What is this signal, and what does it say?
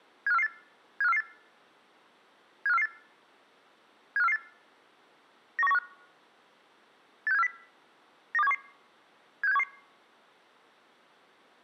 Five-tone selective call (EEA), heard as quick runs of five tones, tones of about 40 ms. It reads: 75448 75448 75448 75448 91915 86740 92711 76711